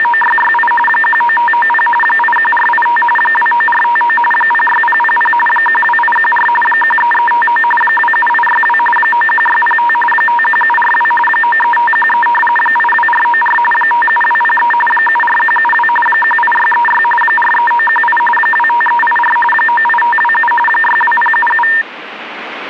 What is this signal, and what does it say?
RTTY (45.45 baud, 850 Hz shift), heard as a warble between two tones, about 1380 Hz centre, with radio static. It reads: … 19590 81485 29459 06000 12814 13359 27862 91605 51742 93513 82494 57203 74172 18636 43918 25384 98527 62077